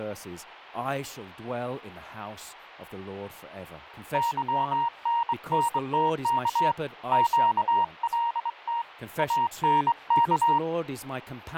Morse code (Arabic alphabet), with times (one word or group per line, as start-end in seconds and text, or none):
4.1-6.7 ظننتك
7.1-8.8 قلت
9.2-10.6 انك